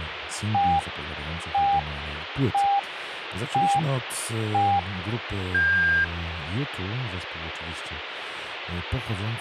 Radio time signal (five pips and a higher one, as on Chinese radio), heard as pips, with radio static and speech in Polish.